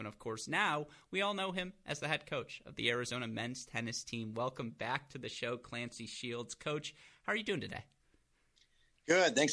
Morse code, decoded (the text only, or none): none